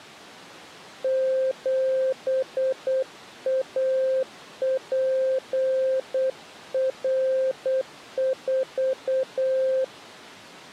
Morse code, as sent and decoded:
--... .- .--. .-. ....-
7APR4

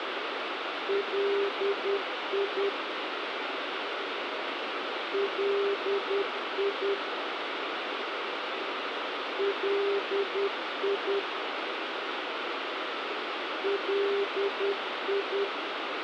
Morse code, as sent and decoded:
.-.. .. / .-.. .. / .-.. .. / .-.. ..
LI LI LI LI

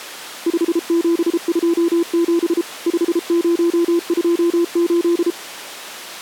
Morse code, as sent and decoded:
..... --... ..--- --... / ..... ----- ..--- ---..
5727 5028

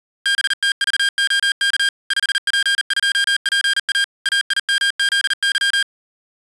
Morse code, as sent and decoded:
-... - ...- --- -.- / ..... .--. ..--- .--. .- / .- .. -- --.. -.--
BTVOK 5P2PA AIMZY

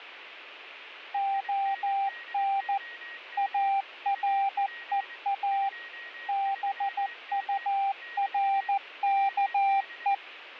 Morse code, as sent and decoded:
--- -. / .- .-. . .- / -... ..- .-. -.- .
ON AREA BURKE

